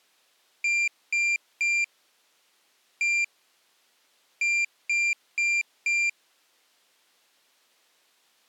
Beep code, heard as a piezo beeper, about 2400 Hz. 3-1-4. In Phoenix BIOS tables: interrupt mask register failure.